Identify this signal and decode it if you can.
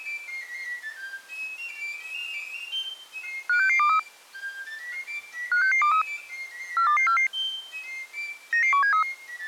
Five-tone selective call (CCIR), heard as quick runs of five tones, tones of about 100 ms. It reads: 56623 56623 42244 99173